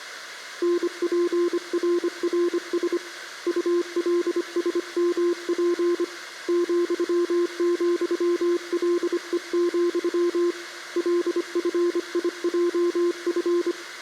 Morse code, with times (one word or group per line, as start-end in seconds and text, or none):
0.6-3.0 NPRRS
3.5-6.0 ULSMP
6.5-10.5 ,,LE,
11.0-13.7 LFIJF